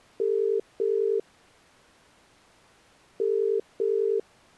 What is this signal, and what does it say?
Telephone call progress tone (as in the UK, Ireland, Australia and similar networks), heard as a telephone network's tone, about 400, 450 Hz. Ringback tone.